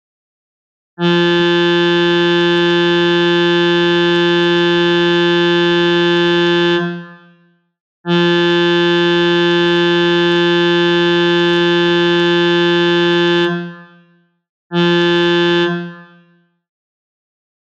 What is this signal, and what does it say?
Ship horn signal, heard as a ship's horn, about 170 Hz, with room echo. 2 long, 1 short. At sea: I intend to overtake on your starboard side.